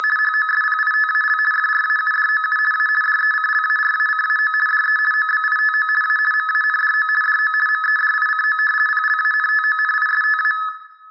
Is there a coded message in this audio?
Yes: RTTY (50 baud, 450 Hz shift) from 0.0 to 10.7 s, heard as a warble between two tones, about 1500 Hz centre, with room echo. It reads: … HOSPITAL FRAUDOU A DECLARACAO DE OBITO A MANDO DO MEDICO PLANTONISTA